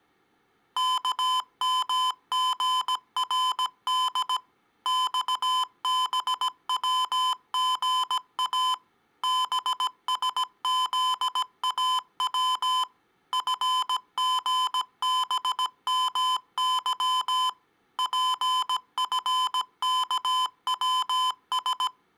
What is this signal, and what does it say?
Morse code, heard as electronic beeps, machine-sent, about 17 wpm, 1020 Hz. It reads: KMGRD XBWGA BSZAW FGBMY PFKWS